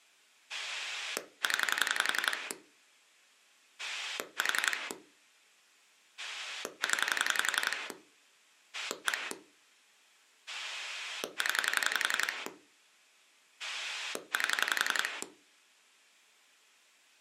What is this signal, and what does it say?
Pulse dialling, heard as a rotary dial, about 11 pulses a second. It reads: 0 4 0 1 0 8